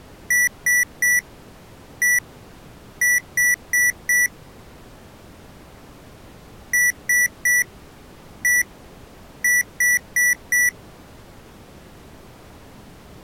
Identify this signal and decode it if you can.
Beep code, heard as beeps from a small speaker, played twice, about 1950 Hz. 3-1-4. In Phoenix BIOS tables: interrupt mask register failure.